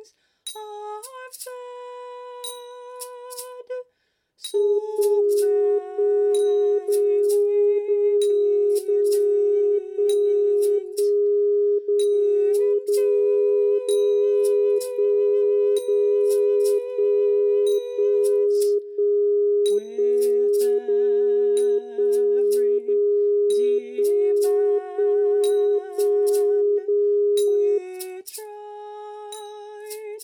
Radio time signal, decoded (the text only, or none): 1 1 0 0 0 1 1 0 0 0 1 0 1 1 1 1 0 1 0 1 1 1 0